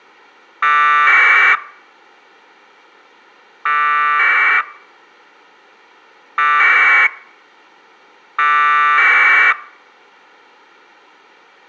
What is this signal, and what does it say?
Packet radio (AX.25, as in APRS), 1200 baud, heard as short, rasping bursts.